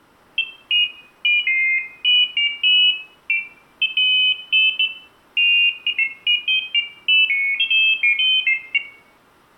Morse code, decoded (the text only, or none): none